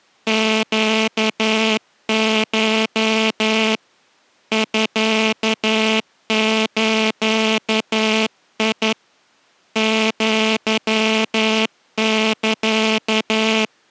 Morse code (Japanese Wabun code), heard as a buzzer, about 11 wpm. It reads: ネコ ミズ アサ